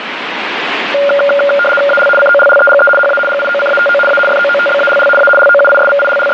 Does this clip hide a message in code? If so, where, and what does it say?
Yes: RTTY (75 baud, 850 Hz shift) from 0.9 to 6.3 s, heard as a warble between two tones, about 990 Hz centre, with radio static. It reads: AL COLLEGE HA GIOCATO A FOOTBALL A …